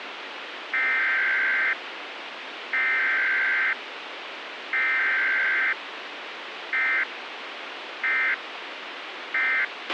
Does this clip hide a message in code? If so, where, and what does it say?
Yes: Emergency Alert System (SAME) tones (header bursts, then end-of-message bursts) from 0.7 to 9.6 s, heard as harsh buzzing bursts, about 520.83 baud, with radio hiss and a squelch burst at the end.